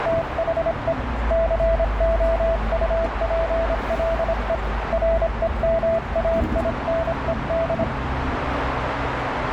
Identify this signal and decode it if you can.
Morse code, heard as a keyed tone, hand-sent with a paddle, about 26 wpm, 660 Hz, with heavy radio static, a narrow filter and the noise inside a bus. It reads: THE COUPLE REMAINED